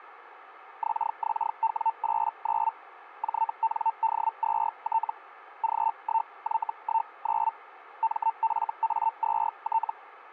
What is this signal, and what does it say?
Hellschreiber (Feld-Hell, 122.5 baud), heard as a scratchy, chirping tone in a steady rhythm, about 900 Hz, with radio static. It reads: XXW89 JND2T G1Y19 MFA2T